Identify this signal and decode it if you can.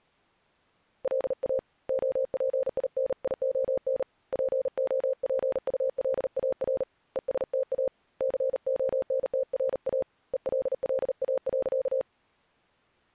Morse code, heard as a keyed tone, hand-sent with a paddle, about 38 wpm, 530 Hz. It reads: LA OPINION POPULAR ESTA CONTRA ELLA.